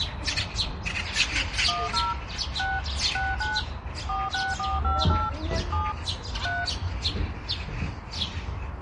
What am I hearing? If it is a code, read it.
DTMF, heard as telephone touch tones, dialled by machine, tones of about 200 ms, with the noise of a park. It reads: 10 6 69 46458 7 3